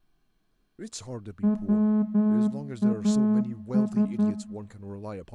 Morse code, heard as a horn, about 10 wpm, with room echo and speech in English. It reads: WAS